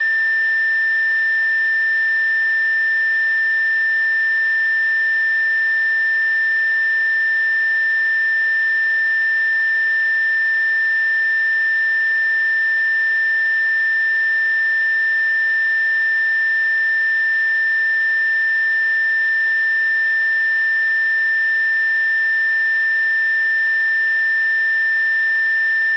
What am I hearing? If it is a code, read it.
A steady tone. There is no code.